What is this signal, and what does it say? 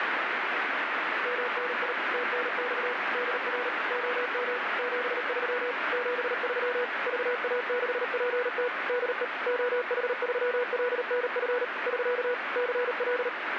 Morse code, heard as a keyed tone, machine-sent, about 38 wpm, 490 Hz, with heavy radio static. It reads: MNI TNX DR OM 73 73 VA6PT DE OH3LNF <SK> CL